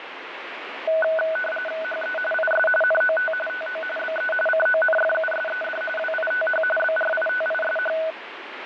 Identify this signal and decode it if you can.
RTTY (45.45 baud, 850 Hz shift), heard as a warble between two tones, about 1070 Hz centre, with radio static. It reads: HE IS NOT TO BE CONFUSED WITH BRITISH